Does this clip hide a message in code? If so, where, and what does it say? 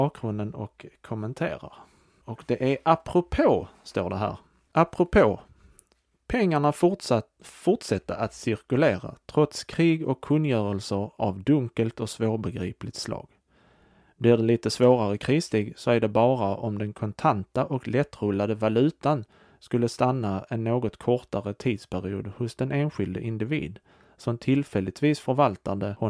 No, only speech in Swedish.